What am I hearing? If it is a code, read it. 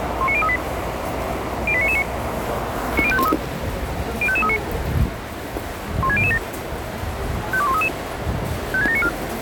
Five-tone selective call (ZVEI), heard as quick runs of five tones, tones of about 70 ms, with the noise of a subway station. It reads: 19038 08999 90513 05539 16007 52133 56794